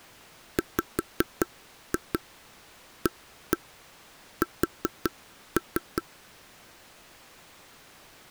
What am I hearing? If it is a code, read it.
Tap code, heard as taps on a table, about 5 knocks a second. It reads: WAS